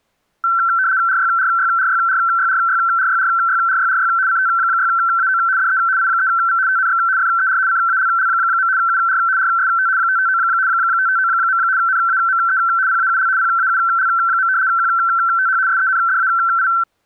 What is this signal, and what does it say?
RTTY (75 baud, 170 Hz shift), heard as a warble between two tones, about 1440 Hz centre. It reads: RYRYRYRYRYRYRYRYRY CT6AO DE I3V TNX FER CALL. UR RST 559 559. NAME PAUL PAUL. QTH SENDAI